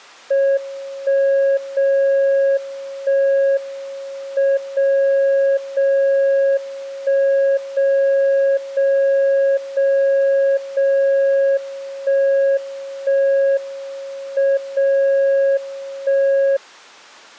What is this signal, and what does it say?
Radio time signal (WWVB), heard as a tone whose level steps once a second, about 550 Hz. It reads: 1 0 1 M 0 0 1 0 0 0 0 1 1 M 0 1